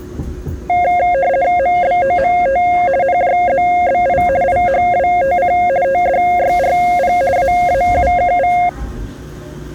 RTTY (50 baud, 170 Hz shift), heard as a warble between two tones, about 630 Hz centre, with the noise inside a subway train. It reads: MBOMT NJZBI IHWTC TDYRP AAUKV